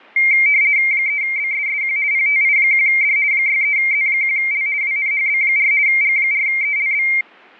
RTTY (50 baud, 170 Hz shift), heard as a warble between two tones, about 2200 Hz centre. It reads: 3BSSQ PTI1D 63Z1L WNHB4 G4ELB